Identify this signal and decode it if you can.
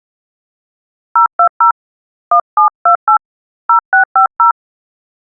DTMF, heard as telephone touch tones, dialled by hand, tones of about 100 ms. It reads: 020 1728 0650